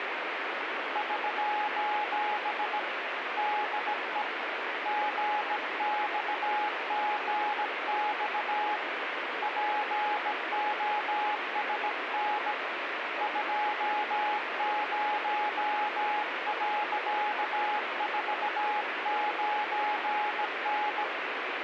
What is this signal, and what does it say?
Morse code, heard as a keyed tone, hand-sent with a bug key, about 17 wpm, 840 Hz, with radio static. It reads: <SOS> DE GXGX POSN 20.49N